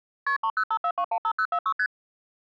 Multi-frequency trunk signalling (R1, as on North American trunks), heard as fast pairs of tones, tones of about 70 ms. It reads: KP 3054215046 ST